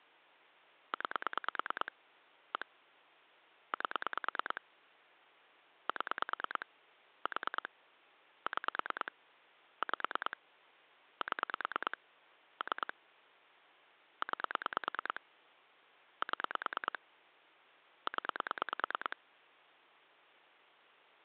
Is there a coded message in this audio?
Yes: pulse dialling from 0.9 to 19.1 s, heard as clicks on a phone line, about 9 pulses a second, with hum. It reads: 9 1 8 7 4 6 5 7 3 9 7 0